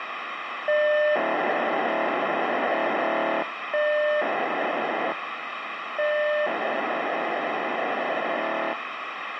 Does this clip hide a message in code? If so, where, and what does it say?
Yes: POCSAG pager data (1200 baud) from 0.7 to 8.7 s, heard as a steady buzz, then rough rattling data, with radio hiss.